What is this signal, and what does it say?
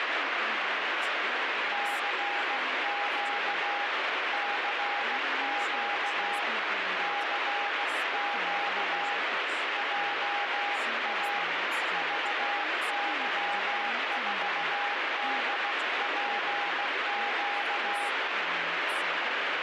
Morse code, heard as a keyed tone, hand-sent with a paddle, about 16 wpm, 810 Hz, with heavy radio static and speech in English. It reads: CQ CQ CQ JA VY4DPQ